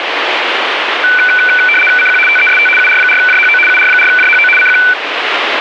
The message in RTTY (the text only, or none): CQ TEST UR4JHO UR4JHO CQ